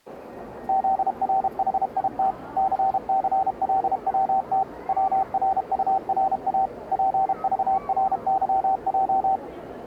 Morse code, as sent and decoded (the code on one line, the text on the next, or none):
--.. .-. .... .. - / -.-. -.-. .-.. .-- - / .-- .-. ..- .-. .- / .--. ...- .-. -.-- .---
ZRHIT CCLWT WRURA PVRYJ